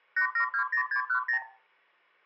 Multi-frequency trunk signalling (R2, with the far end's replies), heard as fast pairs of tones, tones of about 90 ms, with room echo. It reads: 8720610